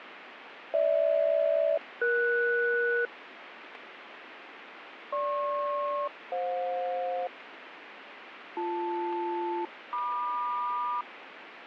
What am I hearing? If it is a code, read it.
Aircraft SELCAL, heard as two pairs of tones, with radio static. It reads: GH-ES GP-FJ BL-MQ